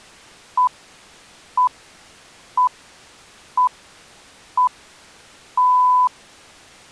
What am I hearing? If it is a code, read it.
Radio time signal (six pips, as the Greenwich Time Signal), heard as pips.